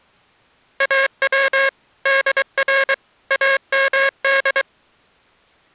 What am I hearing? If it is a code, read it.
Morse code (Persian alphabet), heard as a buzzer, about 23 wpm. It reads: او در امد